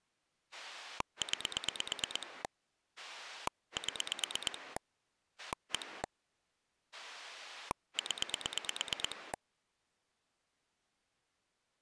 Pulse dialling, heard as a rotary dial, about 8 pulses a second. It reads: 9 7 1 0